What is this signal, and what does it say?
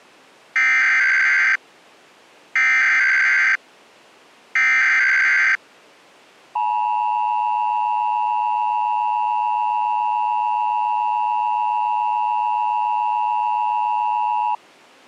Emergency Alert System (SAME) tones (header bursts, then the 853 and 960 Hz attention tone), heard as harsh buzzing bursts, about 520.83 baud.